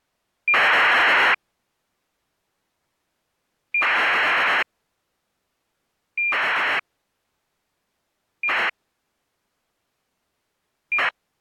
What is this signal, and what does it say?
ACARS aircraft data, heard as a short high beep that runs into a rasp, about 2400 baud.